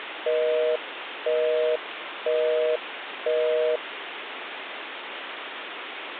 Telephone call progress tone (North American plan), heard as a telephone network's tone, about 480, 620 Hz, 0.5 s on and 0.5 s off, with phone line noise. Busy tone.